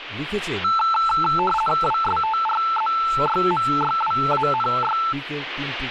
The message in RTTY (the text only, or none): WSTRZYMYWANY